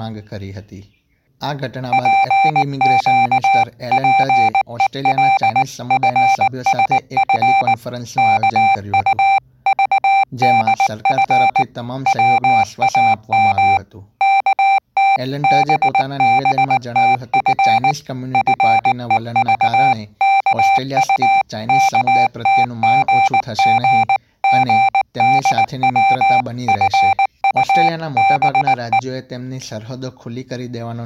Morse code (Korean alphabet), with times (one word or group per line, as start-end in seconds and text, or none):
1.9-7.7 재작년
8.2-11.6 이른
12.1-13.8 봄
14.2-17.9 어떤
18.3-29.0 날이었습니다